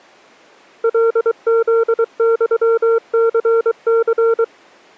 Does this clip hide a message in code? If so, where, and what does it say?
Yes: Morse code (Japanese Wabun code) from 0.8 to 4.5 s, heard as a keyed tone, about 23 wpm, 460 Hz. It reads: カフユニニ